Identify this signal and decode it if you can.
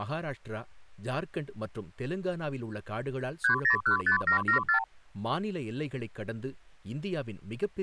Multi-frequency trunk signalling (R2, with the far end's replies), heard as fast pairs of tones, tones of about 100 ms, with speech in Tamil. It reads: 3015774